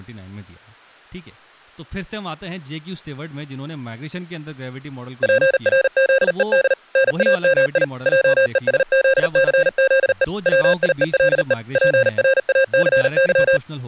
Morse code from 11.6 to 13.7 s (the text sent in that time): PRACY